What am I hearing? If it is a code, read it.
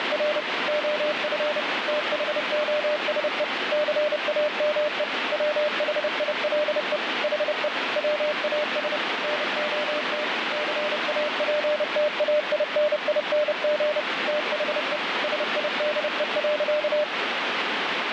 Morse code, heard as a keyed tone, machine-sent, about 30 wpm, 600 Hz, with heavy radio static. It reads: … OF THOSE CAME WHILE HE WAS NOT CAPTAINING THE SIDE.